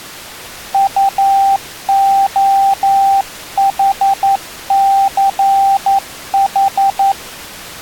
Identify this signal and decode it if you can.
Morse code, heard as a keyed tone, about 11 wpm, 790 Hz. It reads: UOHCH